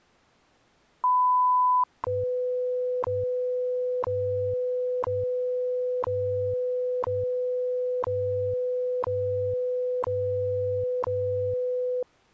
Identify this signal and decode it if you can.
Radio time signal (WWV, Colorado), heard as ticks, one a second.